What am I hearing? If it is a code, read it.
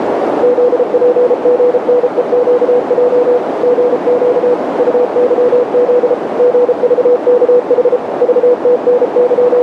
Morse code, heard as a keyed tone, machine-sent, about 33 wpm, 490 Hz, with heavy radio static and a narrow filter. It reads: ZPGNEQJ GQ UYZ GVKH …